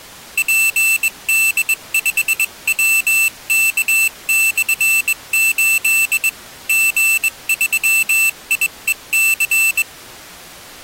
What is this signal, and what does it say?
Morse code, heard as a high beeper, hand-sent with a straight key, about 21 wpm, 2650 Hz. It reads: PD5WK/8 G3IEC